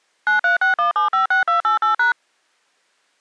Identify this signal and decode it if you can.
DTMF, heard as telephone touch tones, dialled by machine, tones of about 120 ms. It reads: 9361756288#